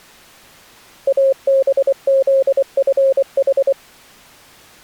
Morse code, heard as a keyed tone, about 24 wpm, 540 Hz. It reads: ABZFH